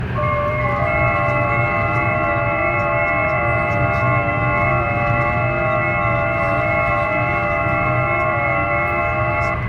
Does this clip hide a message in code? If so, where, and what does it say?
Yes: FT8 (several signals at once) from 0.1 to 9.5 s, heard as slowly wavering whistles, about 6.25 baud, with radio static, room echo and the noise inside a car.